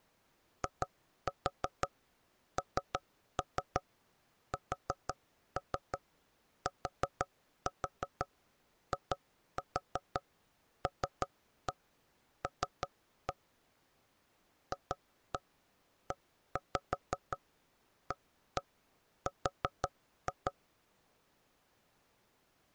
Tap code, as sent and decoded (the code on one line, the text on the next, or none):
2-4 3-3 4-3 4-4 2-4 3-1 3-1 / 2-1 1-5 1-1 4-2
INSTILL FEAR